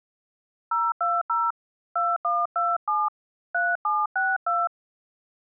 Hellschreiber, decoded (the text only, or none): none